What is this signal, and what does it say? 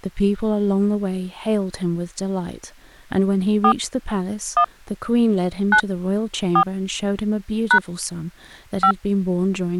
DTMF, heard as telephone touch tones, dialled by hand, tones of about 80 ms, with speech in English. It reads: 4 1 9 4 # 5